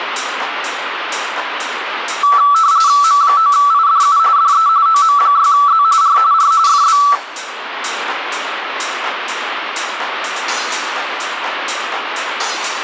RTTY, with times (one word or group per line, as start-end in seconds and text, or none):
3.0-4.2 M9IDU
4.4-4.7 DE
4.9-5.8 OM6Z
6.0-6.2 R
6.3-6.5 R
6.7-7.0 FB